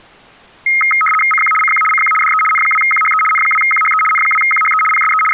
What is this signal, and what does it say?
RTTY (75 baud, 850 Hz shift), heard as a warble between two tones, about 1700 Hz centre. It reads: CQ CQ CQ DE N2QHE N2QHE N2QHE PSE …